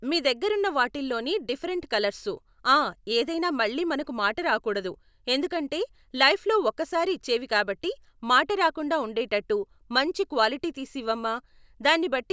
Speech in Telugu. There is no code.